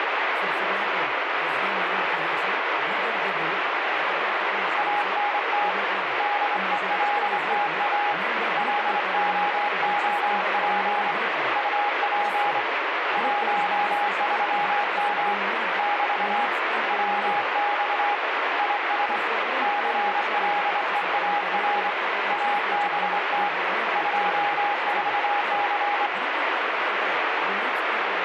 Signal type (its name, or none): Morse code